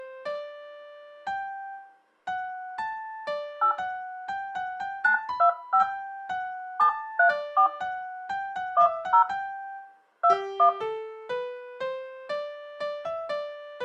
DTMF, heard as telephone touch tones, dialled by hand, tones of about 100 ms. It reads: 8 925 734 10 21